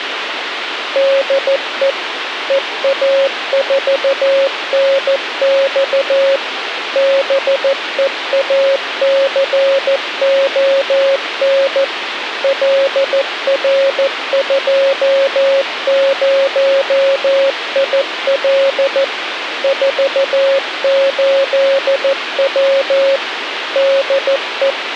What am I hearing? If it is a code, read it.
Morse code, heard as a keyed tone, machine-sent, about 14 wpm, 550 Hz, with radio hiss. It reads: DE EA4NX BEACON LR20IL 48W DE